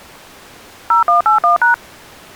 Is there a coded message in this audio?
Yes: DTMF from 0.9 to 1.7 s, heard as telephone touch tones, dialled by machine, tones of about 130 ms. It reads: 0181#